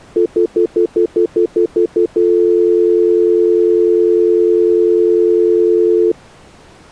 Telephone call progress tone (North American plan), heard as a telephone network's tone, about 350, 440 Hz, 0.1 s on and 0.1 s off. Stutter dial tone.